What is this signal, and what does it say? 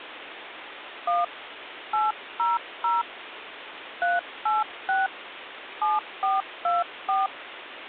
DTMF, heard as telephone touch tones, dialled by hand, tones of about 180 ms, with phone line noise. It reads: 1 800 386 7424